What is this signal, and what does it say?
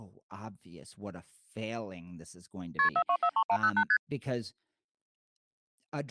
Multi-frequency trunk signalling (R1, as on North American trunks), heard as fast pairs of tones, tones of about 70 ms, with speech in English. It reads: KP 4243108 ST